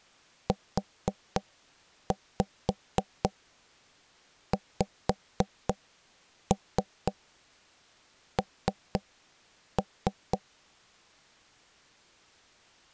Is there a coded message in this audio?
Yes: tap code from 0.5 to 10.4 s, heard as knocks on wood, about 4 knocks a second. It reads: UXN